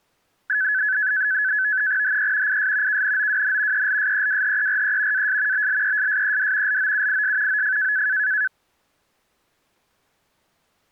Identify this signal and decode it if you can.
NAVTEX (SITOR-B), 100 baud, 170 Hz shift, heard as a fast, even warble, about 1600 Hz centre. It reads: HE IS KNOWN ELSEWHERE AS BLESSED LOUIS OF